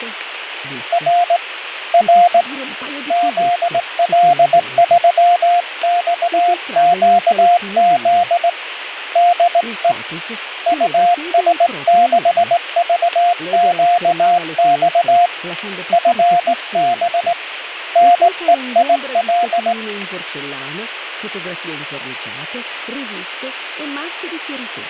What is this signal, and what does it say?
Morse code, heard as a keyed tone, hand-sent with a straight key, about 18 wpm, 700 Hz, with radio static. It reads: R R ZL3XQZ DE US6VQX FB NEIL